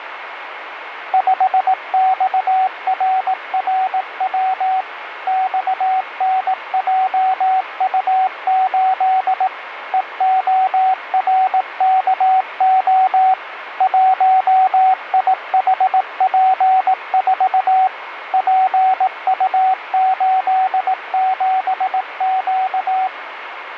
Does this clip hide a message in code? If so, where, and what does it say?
Yes: Morse code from 1.1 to 23.1 s, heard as a keyed tone, machine-sent, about 18 wpm, 760 Hz, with radio static. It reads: 5XRRW XNJU8 EORKO 1IHP4 PU87Q